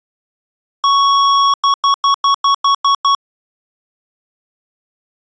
Beep code, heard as beeps from a small speaker, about 1110 Hz. 1 long, 8 short. In AMI BIOS tables: display or retrace test failure.